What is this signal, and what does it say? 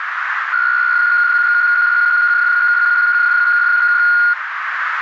PSK63 (62.5 baud), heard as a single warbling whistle, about 1430 Hz, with radio static and a narrow filter.